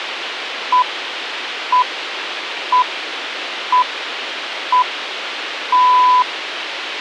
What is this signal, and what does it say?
Radio time signal (six pips, as the Greenwich Time Signal), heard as pips, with radio hiss.